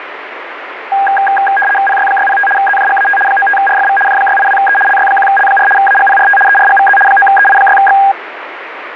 RTTY (75 baud, 850 Hz shift), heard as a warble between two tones, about 1210 Hz centre, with radio static. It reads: PY605 ZJGAT 95RFV J682E LY1L4 AGPRT ERGVZ 9EI6X